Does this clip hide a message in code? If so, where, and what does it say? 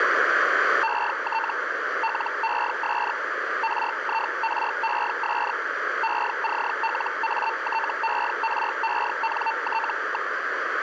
Yes: Hellschreiber (Feld-Hell, 122.5 baud) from 0.8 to 10.3 s, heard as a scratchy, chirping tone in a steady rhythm, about 900 Hz, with radio static. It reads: ET LES RIRES ECLATERENT.